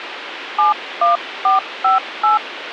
DTMF, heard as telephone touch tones, dialled by hand, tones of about 140 ms, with radio hiss. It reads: 71458